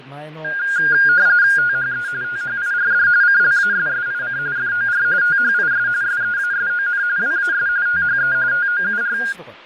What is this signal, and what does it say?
RTTY (45.45 baud, 170 Hz shift), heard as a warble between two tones, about 1500 Hz centre, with fading and speech in Japanese. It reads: THE THIRD CLASSIC FOR THIS SEASON WAS THE TOUR